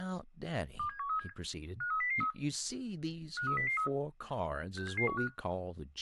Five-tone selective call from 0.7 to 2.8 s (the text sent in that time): 27137 53003